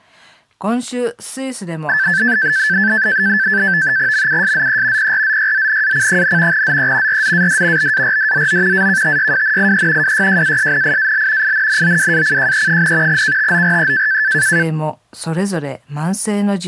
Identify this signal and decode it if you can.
NAVTEX (SITOR-B), 100 baud, 170 Hz shift, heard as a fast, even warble, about 1650 Hz centre. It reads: MUSZE PRZYZNAC, ZE RZAD BARDZO AKTYWNIE WYJASNIAL INNOWACJE, KTORE